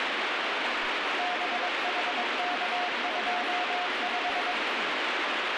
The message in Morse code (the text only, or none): BHK25